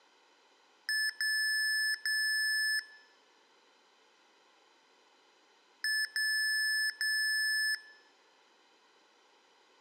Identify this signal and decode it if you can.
Beep code, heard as beeps from a small speaker, played twice, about 1750 Hz, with room echo. 1 short, 2 long.